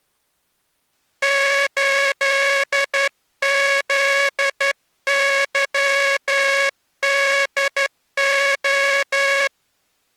Morse code, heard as a buzzer, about 11 wpm. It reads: 8ZYDO